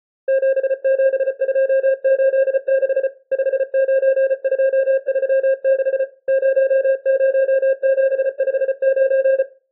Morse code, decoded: 77286 59236 00759

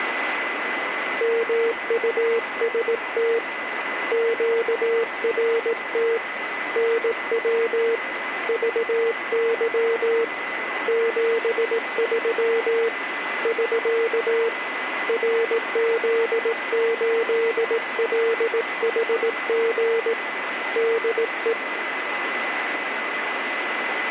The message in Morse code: MUST QRT NW VY 73 <SK> RZ8LHG DE

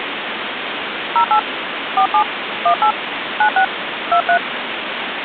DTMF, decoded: 08 47 18 96 23

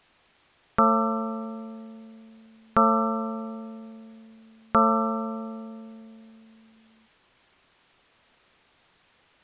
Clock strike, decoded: 3

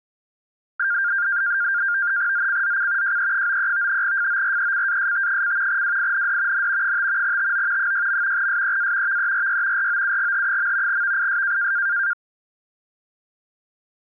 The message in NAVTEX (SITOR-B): ZCZC JE93 FORECAST: WIND N 5 TO 6. SEA VERY ROUGH. VIS

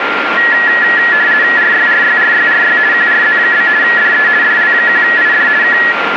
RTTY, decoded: RYRYRYRY QRZ? DE DL1ID K

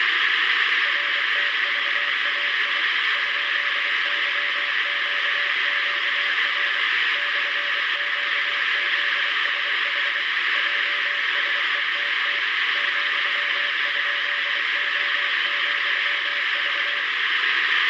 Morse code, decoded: RTVAI ?YQQR /QZSH JSETT ,?O,V

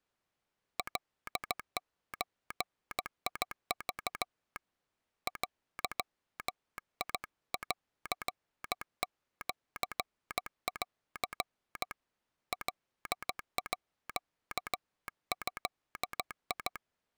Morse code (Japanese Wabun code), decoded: カゾク デンシン カード

